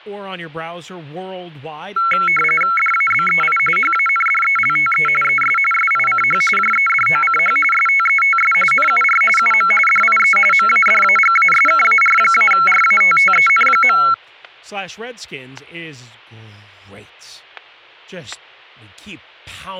RTTY (45.45 baud, 850 Hz shift), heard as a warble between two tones, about 1800 Hz centre, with static crashes and speech in English. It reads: DABEI HANDELTE ES SICH JEDOCH STETS NUR UM DIE MADAGASKAR-RATTEN.